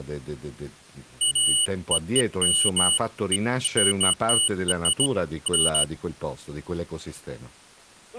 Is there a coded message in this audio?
No, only beeps of irregular length, with speech in Italian.